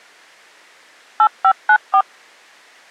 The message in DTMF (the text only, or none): 8594